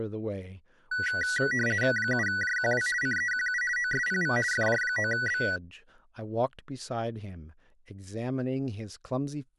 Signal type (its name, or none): RTTY